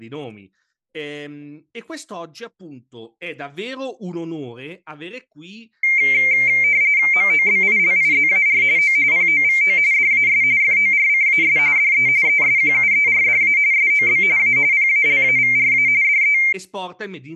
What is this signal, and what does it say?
RTTY (45.45 baud, 170 Hz shift), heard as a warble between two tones, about 2200 Hz centre, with speech in Italian. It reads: MOBILIZAR O POVO DAS FORCAS DE ESQUERDA SOB A PALAVRA DE